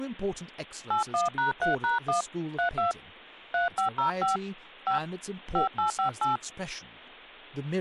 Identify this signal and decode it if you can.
DTMF, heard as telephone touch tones, dialled by hand, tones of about 130 ms, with speech in English. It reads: 81#3#1 32 3505 5 5858